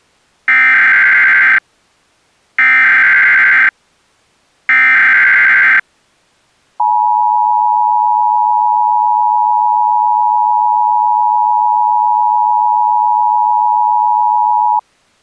Emergency Alert System (SAME) tones (header bursts, then the 853 and 960 Hz attention tone), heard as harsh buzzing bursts, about 520.83 baud.